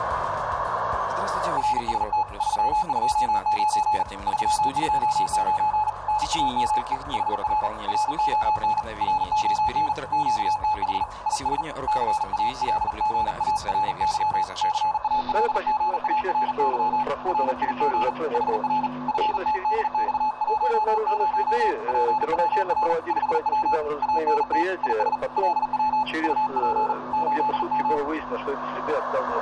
Morse code, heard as a keyed tone, hand-sent with a paddle, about 39 wpm, 860 Hz, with radio static and room echo. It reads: RST 329 329 NAME HR RON RON QTH IS CALGARY CALGARY RIG HR FTDX10 PWR 5W ANT IS LW UP 8M